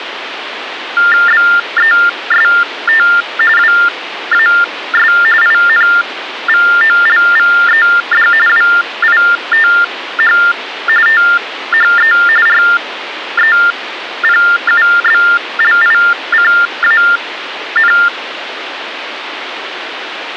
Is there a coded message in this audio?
Yes: TTY/TDD text telephone tones (45.45 baud Baudot) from 1.0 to 18.1 s, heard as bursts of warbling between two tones, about 400 Hz shift, 1600 Hz centre, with phone line noise. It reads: BEST WAS INVOLVED WITH THE REPUBLICAN